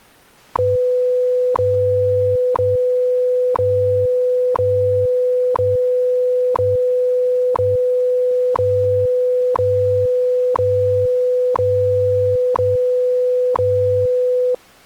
Radio time signal (WWV, Colorado), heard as ticks, one a second.